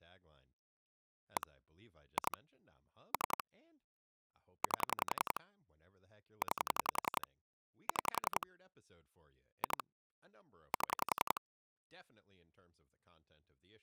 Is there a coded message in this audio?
Yes: pulse dialling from 1.4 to 11.4 s, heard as clicks on a phone line, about 11 pulses a second, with speech in English. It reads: 1 2 3 8 9 6 2 7